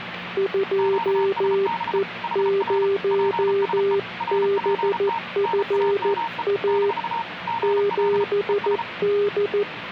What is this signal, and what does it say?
Morse code, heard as two keyed tones, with radio static and the noise inside a subway train. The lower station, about 14 wpm, 400 Hz: 2E0BFA 7D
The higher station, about 33 wpm, 920 Hz: QSB HR PSE RPT NAME - GL ES